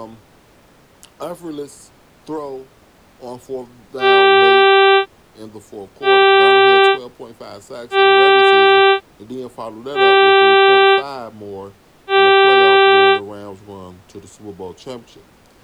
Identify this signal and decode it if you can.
Ship horn signal, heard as a ship's horn, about 390 Hz, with speech in English. 5 short. At sea: I doubt that you are doing enough to avoid a collision.